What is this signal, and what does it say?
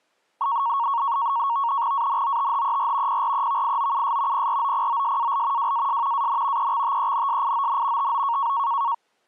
NAVTEX (SITOR-B), 100 baud, 170 Hz shift, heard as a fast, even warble, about 1020 Hz centre. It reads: ANOTHER PREVIOUS PROPOSAL WAS AN EXTENSION TO